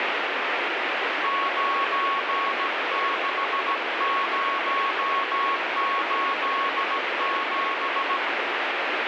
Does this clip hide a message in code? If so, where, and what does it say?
Yes: Morse code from 1.2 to 8.2 s, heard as a keyed tone, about 16 wpm, 1100 Hz, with heavy radio static. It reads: 96087